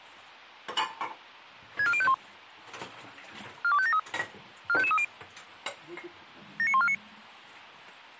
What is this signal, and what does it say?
Five-tone selective call (ZVEI), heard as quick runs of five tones, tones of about 70 ms, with a squelch burst at the end and kitchen noise. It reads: 64051 42573 45530 79149